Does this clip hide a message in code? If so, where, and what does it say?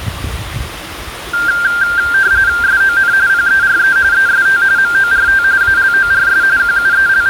Yes: RTTY (45.45 baud, 170 Hz shift) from 1.3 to 7.3 s, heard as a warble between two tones, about 1490 Hz centre, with room echo and the noise of a park. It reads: SON PERE EST MORT ALORS …